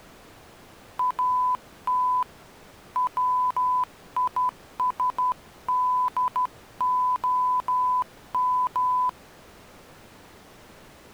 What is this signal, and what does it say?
Morse code, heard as a keyed tone, hand-sent with a straight key, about 12 wpm, 1000 Hz. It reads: AT WISDOM